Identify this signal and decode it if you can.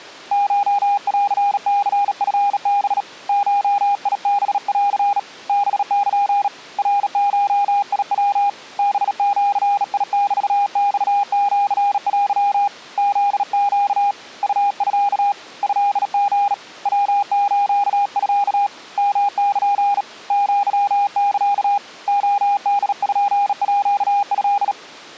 Morse code (Japanese Wabun code), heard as a keyed tone, hand-sent with a bug key, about 37 wpm, 810 Hz. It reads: コンニチハ ゴハン ハル ナゴヤ ハジメマシテ フネ ウミ トリ ヤスミ ヨル アサ レポート